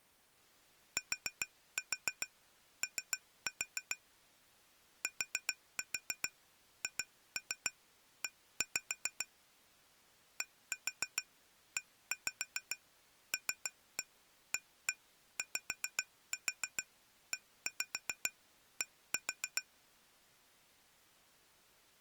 Tap code, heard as taps on glass, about 7 knocks a second. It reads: TO THE DELAYED